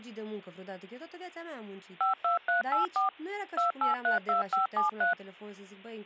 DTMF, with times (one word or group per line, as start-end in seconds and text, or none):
2.0-3.1 52384
3.6-5.1 2832573